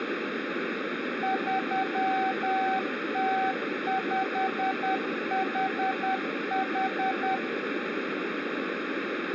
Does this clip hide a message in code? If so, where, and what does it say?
Yes: Morse code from 1.2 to 7.4 s, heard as a keyed tone, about 10 wpm, 760 Hz, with radio static and room echo. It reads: 3T5HH